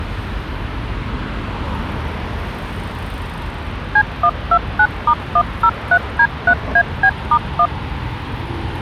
DTMF, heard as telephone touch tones, dialled by machine, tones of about 70 ms, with street noise. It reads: C129*103D3AB*1